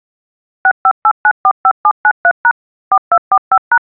DTMF, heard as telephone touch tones, dialled by machine, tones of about 60 ms. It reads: 658945793# 4245#